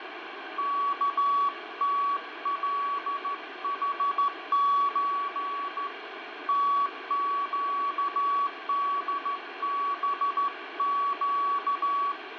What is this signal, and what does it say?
Morse code (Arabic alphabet), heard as a keyed tone, hand-sent with a straight key, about 14 wpm, 1130 Hz, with radio static, fading and room echo. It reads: كتلحز تقدبق